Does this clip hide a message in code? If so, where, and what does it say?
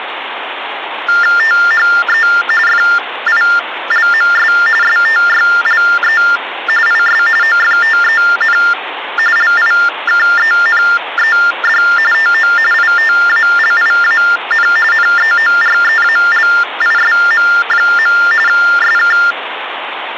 Yes: TTY/TDD text telephone tones (45.45 baud Baudot) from 1.1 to 19.3 s, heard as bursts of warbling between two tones, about 400 Hz shift, 1600 Hz centre, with phone line noise. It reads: THE FILMS STYLE IS OFTEN LIKENED TO ITALIAN NEOREALISM. SK